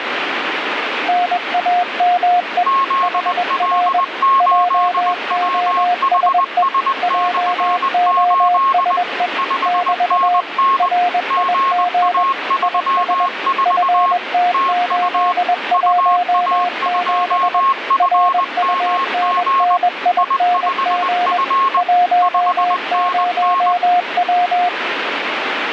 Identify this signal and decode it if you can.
Morse code, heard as two keyed tones, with radio static. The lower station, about 21 wpm, 710 Hz: NAME HR JOSE JOSE <BT> RIG IS FT817 RUNNING 10W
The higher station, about 20 wpm, 1080 Hz: ZL8WHS/8 5NN GA34 TU UA2FMG I5F 5NN